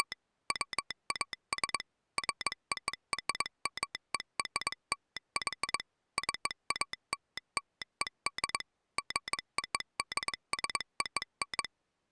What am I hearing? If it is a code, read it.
Morse code (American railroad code), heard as a telegraph sounder, machine-sent. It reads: … WAS FORMERLY CALLED GODSON